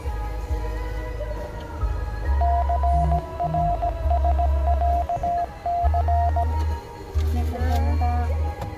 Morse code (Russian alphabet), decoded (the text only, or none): ЦРСЯЦ